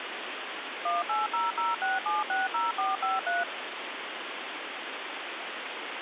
DTMF, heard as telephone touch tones, dialled by machine, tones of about 170 ms, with phone line noise. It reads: 18006760453